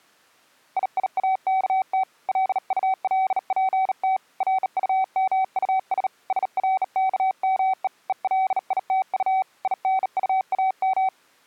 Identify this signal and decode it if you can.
Morse code, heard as a keyed tone, hand-sent with a bug key, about 38 wpm, 760 Hz. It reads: IIAKT LULPT RUMUS SRKME ELITU INUAM